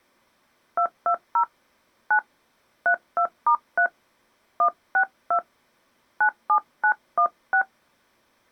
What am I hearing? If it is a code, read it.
DTMF, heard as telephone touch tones, dialled by hand, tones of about 80 ms. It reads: 220 9 32*3 162 97916